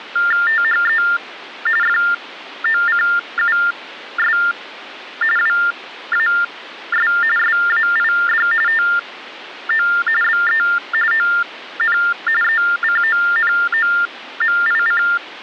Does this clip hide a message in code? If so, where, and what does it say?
Yes: TTY/TDD text telephone tones (45.45 baud Baudot) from 0.2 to 15.2 s, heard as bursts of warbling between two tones, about 400 Hz shift, 1600 Hz centre. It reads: THE FOCUS WAS SAID TO BE ON ECONOMIC